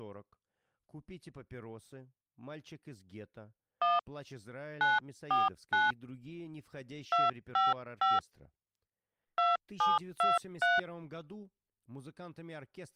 DTMF, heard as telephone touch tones, dialled by hand, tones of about 180 ms, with speech in Russian. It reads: 1 949 255 2723